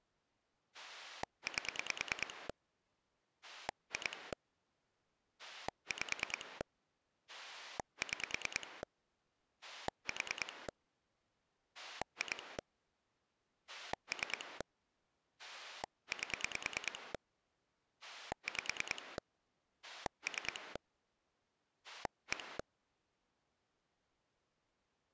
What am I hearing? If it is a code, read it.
Pulse dialling, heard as a rotary dial, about 9 pulses a second. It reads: 8 2 5 6 4 2 3 8 5 3 1